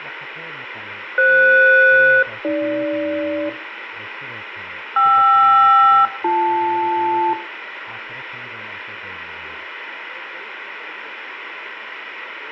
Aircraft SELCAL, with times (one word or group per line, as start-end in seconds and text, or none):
1.2-3.5 FS-AG
5.0-7.3 KR-BL